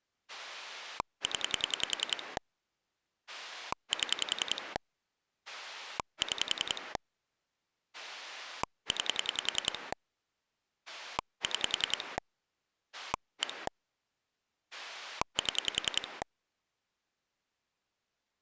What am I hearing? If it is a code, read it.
Pulse dialling, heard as a rotary dial, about 10 pulses a second. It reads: 0 7 6 9 6 1 7